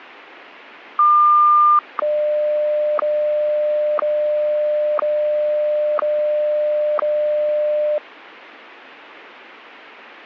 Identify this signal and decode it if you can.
Radio time signal (WWVH, Hawaii), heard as ticks, one a second.